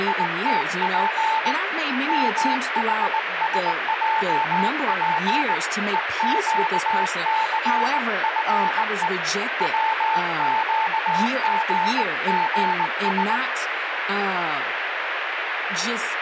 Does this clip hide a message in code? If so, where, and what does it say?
Yes: Morse code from 0.0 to 13.4 s, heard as a keyed tone, hand-sent with a bug key, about 19 wpm, 890 Hz, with radio static and speech in English. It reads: … MHSJP EQCFE WQGGS